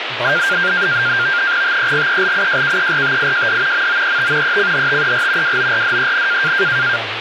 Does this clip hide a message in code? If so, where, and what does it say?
Yes: NAVTEX (SITOR-B), 100 baud, 170 Hz shift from 0.2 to 7.0 s, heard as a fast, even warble, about 1500 Hz centre, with radio static and speech in Sindhi. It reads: TEGELIJKERTIJD MOET ECHTER WORDEN